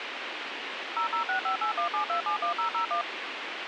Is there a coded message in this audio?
Yes: DTMF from 1.0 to 3.0 s, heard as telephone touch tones, dialled by machine, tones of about 110 ms, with radio hiss. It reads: 0065817271001